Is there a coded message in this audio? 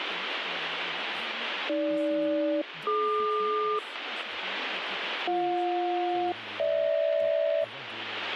Yes: aircraft SELCAL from 1.7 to 7.6 s, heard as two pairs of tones, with radio static and speech in French. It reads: AG-DQ BJ-GH